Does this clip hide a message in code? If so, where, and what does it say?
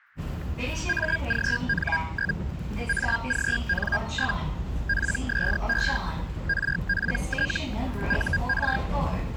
Yes: Hellschreiber (Feld-Hell, 122.5 baud) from 0.9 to 8.8 s, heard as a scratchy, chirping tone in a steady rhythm, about 1600 Hz, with static crashes and the noise inside a subway train. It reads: AGN? AGN? PSE RPT UR